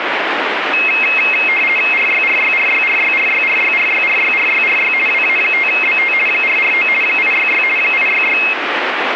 RTTY (50 baud, 450 Hz shift), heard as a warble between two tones, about 2350 Hz centre, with radio static. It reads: RYRYRYRYRYRYRYRYRYRY WA5BT 449 866 866